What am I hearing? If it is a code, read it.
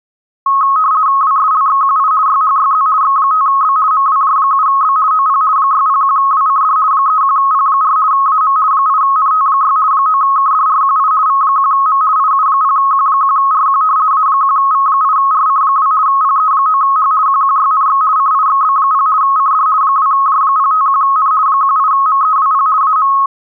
RTTY (50 baud, 170 Hz shift), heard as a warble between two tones, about 1180 Hz centre. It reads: WSLXQI YHYZ X5B MWJ7B OP 601WCD 31P4 AM 8NT6 9KDRQI V1M IU0Q1RQ A1V8RC2 PE9H QQYNX CIXB0 CD 2J051N 18MEWP AM